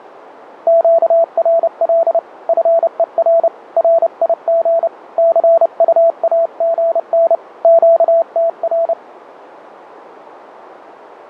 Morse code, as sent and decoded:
--.- .-. .-.. / ..-. . .-. / .-. .. --. / -.-. ..- .- --. -. / --.- - .-.
QRL FER RIG CUAGN QTR

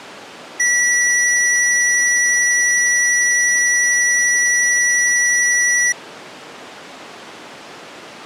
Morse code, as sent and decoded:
none

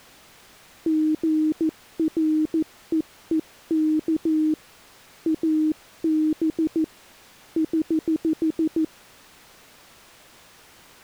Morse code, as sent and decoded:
--. .-. . . -.- / .- -... / ........
GREEK AB <HH>

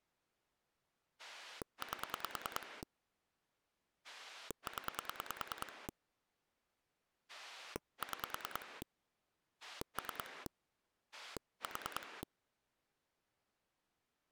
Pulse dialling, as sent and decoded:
8 / 10 / 6 / 3 / 4
8 0 6 3 4

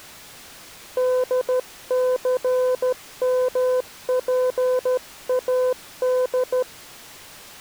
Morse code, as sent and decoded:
-.. -.-. -- .--. .- -..
DCMPAD

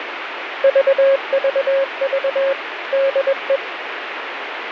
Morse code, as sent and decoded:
...- ...- ...- / -.. .
VVV DE

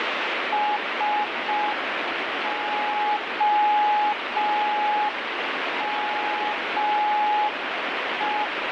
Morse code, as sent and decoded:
... --- -- .
SOME

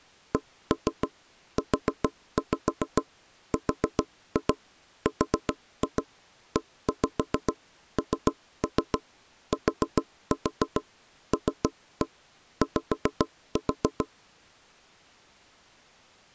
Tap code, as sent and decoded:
1-3 4-5 4-2 4-2 1-5 3-3 4-4 3-1 5-4
CURRENTLY

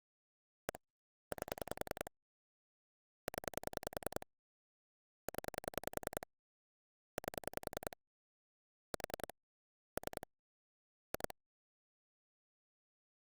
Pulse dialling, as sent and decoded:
1 / 8 / 10 / 10 / 8 / 4 / 3 / 2
1 8 0 0 8 4 3 2

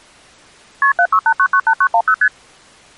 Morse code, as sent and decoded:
none

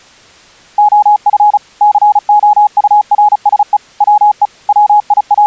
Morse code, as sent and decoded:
--- ..-. / -.-. --- ..- .-. ... . / .-- . / …
OF COURSE WE …

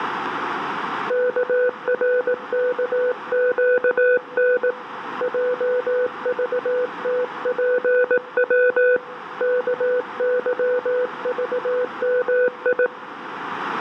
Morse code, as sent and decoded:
-.- .-. -.- --.- -. / .--- ...- - .--. .-- / -.- -.-- ...- -- ..
KRKQN JVTPW KYVMI

